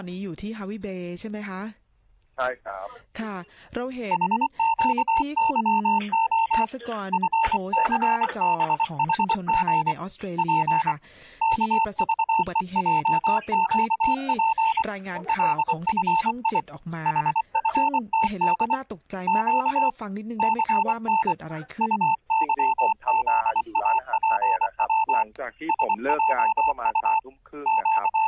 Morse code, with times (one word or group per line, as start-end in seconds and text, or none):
4.1-6.6 HQYO
7.1-9.9 FCBHG
10.4-10.9 P
11.4-14.8 KVEJQP
15.3-16.6 LFI
17.1-18.8 HFTD
19.3-19.9 Q
20.4-21.3 CN
21.8-25.2 UYZAPW
25.7-27.2 SJU
27.7-28.3 …